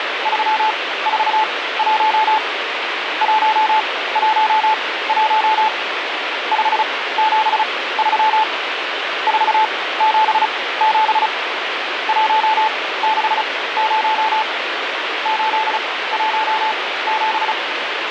Morse code, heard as a keyed tone, machine-sent, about 35 wpm, spaced as for 18 wpm, 870 Hz, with radio static. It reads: 341 111 573 477 160 817